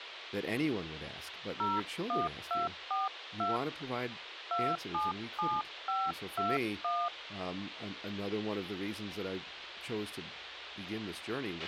DTMF, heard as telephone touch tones, dialled by hand, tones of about 190 ms, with radio hiss, a squelch burst at the end and speech in English. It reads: 01242 277521